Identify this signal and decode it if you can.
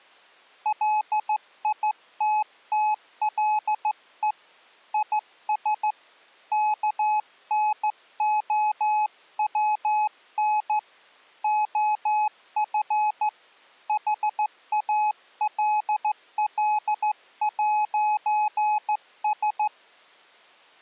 Morse code, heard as a keyed tone, hand-sent with a straight key, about 14 wpm, 850 Hz. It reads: LITTLE IS KNOWN OF HALL'S